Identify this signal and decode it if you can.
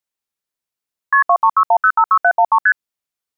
Multi-frequency trunk signalling (R1, as on North American trunks), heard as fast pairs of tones, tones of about 70 ms. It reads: KP 2361056713 ST